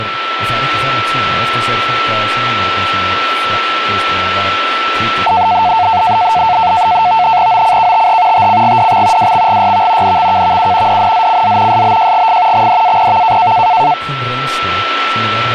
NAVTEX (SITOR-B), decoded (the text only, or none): OCKTH TCGDX WXGYV NXKVU DNZCZ SBJGF XDAPV